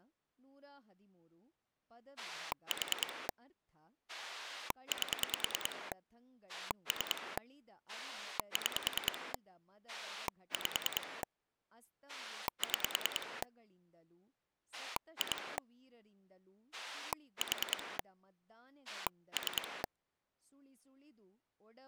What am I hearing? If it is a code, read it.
Pulse dialling, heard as a rotary dial, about 10 pulses a second, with speech in Kannada. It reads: 4 8 3 6 5 6 2 4 3